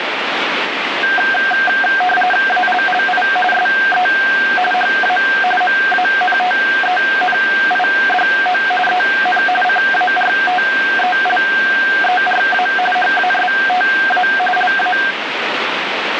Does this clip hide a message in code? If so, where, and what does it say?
Yes: RTTY (45.45 baud, 850 Hz shift) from 1.0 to 15.1 s, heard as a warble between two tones, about 1150 Hz centre, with radio static. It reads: ALLI SE HA MANTENIDO EN CARTELERA HASTA LA